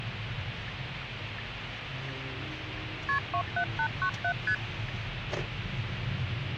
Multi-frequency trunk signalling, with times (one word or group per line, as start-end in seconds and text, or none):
3.1-3.2 KP
3.3-4.3 27897
4.5-4.5 ST